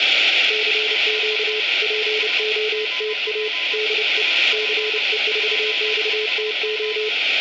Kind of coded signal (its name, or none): Morse code